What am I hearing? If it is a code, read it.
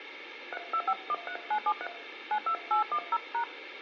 DTMF, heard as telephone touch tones, dialled by hand, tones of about 80 ms, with room echo. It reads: 32513973 92810#